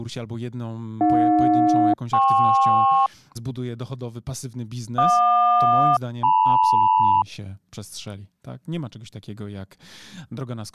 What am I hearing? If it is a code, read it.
Aircraft SELCAL, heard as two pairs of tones, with speech in Polish. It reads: AJ-KP JQ-LM